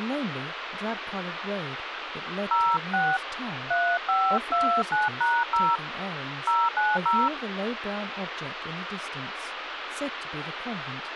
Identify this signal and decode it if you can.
DTMF, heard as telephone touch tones, dialled by hand, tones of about 230 ms, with phone line noise and speech in English. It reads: 06 3529#0 090